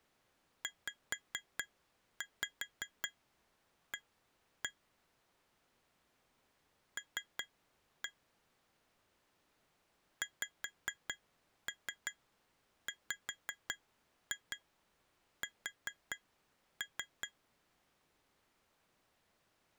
Tap code, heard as taps on glass, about 5 knocks a second. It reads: ZA L XWS